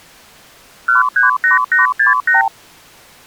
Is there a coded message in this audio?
Yes: multi-frequency trunk signalling (R2, with the far end's replies) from 0.9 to 2.5 s, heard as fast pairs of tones, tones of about 140 ms. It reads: 138868